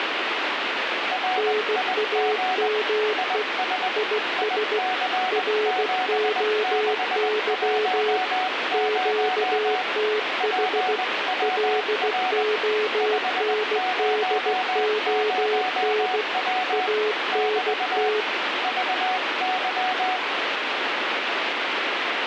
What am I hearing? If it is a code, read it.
Morse code, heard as two keyed tones, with radio static. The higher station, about 20 wpm, 740 Hz: RIG IS IC7610 PWR 500W <BT> VY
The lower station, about 16 wpm, 430 Hz: NAME IS ROY QTH LONDON ANT